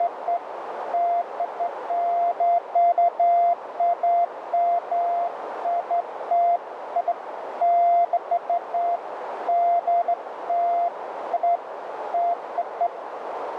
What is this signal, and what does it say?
Beeps of irregular length, with radio static and a narrow filter. There is no code.